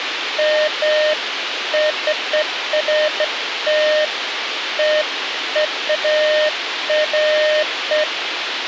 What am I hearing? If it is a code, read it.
Beeps of irregular length, with radio hiss. There is no code.